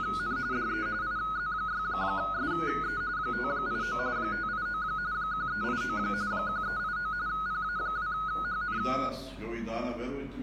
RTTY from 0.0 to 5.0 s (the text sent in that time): … DE IZ6SE 589 589